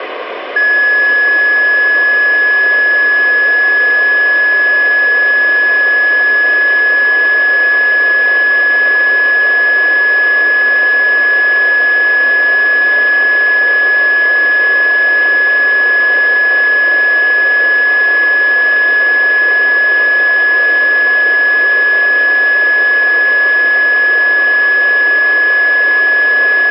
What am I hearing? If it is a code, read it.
A steady tone, with radio static. There is no code.